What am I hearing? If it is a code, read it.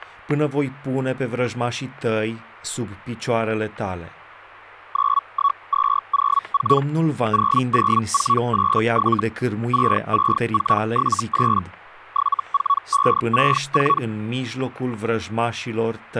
Hellschreiber (Feld-Hell, 122.5 baud), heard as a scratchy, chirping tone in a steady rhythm, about 1120 Hz, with static crashes and speech in Romanian. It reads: 91204 00487 66478 74564